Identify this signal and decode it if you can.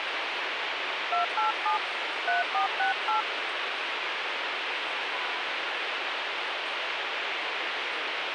DTMF, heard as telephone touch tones, dialled by hand, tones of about 130 ms, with radio hiss and the noise of a residential street. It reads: 287 3468